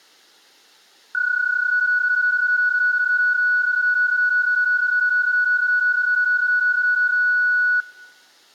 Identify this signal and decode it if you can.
PSK31 (31.25 baud), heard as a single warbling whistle, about 1470 Hz.